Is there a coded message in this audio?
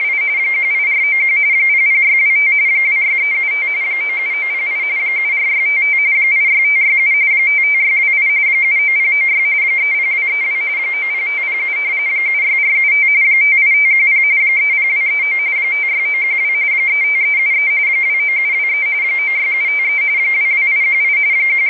Yes: RTTY (45.45 baud, 170 Hz shift) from 0.0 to 21.7 s, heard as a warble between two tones, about 2200 Hz centre, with radio static. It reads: … 18491 00625 26375 97908 74655 86567 55628 79096 30232 90507 76475 58510 30239 56912 35373 29723 96753 22818 …